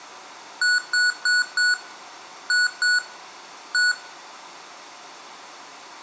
Beep code, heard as beeps from a small speaker, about 1470 Hz, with room echo. 4-2-1. In Phoenix BIOS tables: timer tick failure.